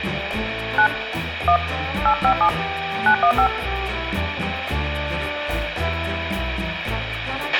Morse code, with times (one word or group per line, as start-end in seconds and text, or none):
none